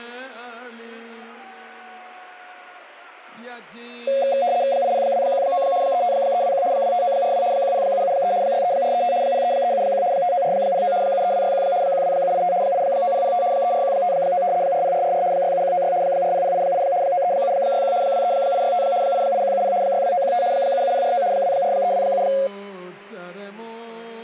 RTTY (75 baud, 170 Hz shift), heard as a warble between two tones, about 630 Hz centre. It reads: 80219 35321 25942 10773 63435 03371 59409 73261 12785 89005 34159 40444 67196 40088 93761 23865 88170 62915 77049 24327